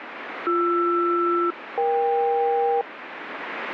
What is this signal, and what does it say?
Aircraft SELCAL, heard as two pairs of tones, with radio static. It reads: BR-EK